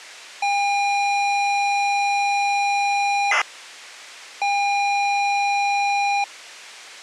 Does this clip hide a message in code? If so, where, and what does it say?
Yes: ZX Spectrum tape loading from 0.4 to 6.2 s, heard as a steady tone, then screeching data.